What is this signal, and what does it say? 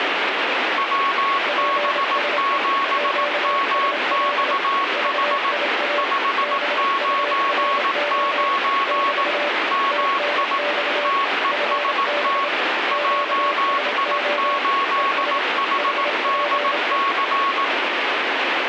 Morse code, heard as two keyed tones, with radio static. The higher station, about 18 wpm, 1100 Hz: WB7MXH 599 MI TEST JI8HDC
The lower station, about 27 wpm, 580 Hz: PSE QSL VIA BURO <BT> TNX FB QSO ES HPE